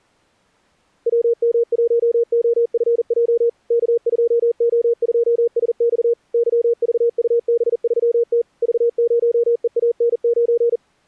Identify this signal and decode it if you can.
Morse code, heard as a keyed tone, machine-sent, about 40 wpm, 470 Hz. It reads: WM1OFJ K2O2SX YVUB3T V0EAN9